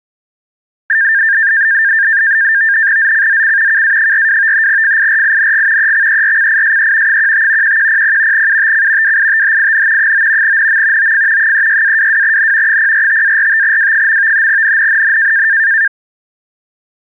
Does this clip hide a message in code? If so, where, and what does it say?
Yes: NAVTEX (SITOR-B), 100 baud, 170 Hz shift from 0.9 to 15.9 s, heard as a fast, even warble, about 1700 Hz centre. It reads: ZCZC KA42 FIRING EXERCISE 15 1100 UTC WITHIN 9 NM OF 36-22N 045-45W. NNNN